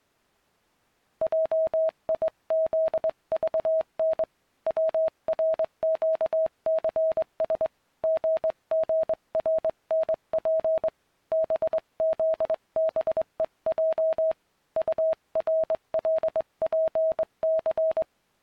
Morse code, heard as a keyed tone, hand-sent with a straight key, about 22 wpm, 640 Hz. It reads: JIZVN WRQCS GGRNP BZBEJ URLPC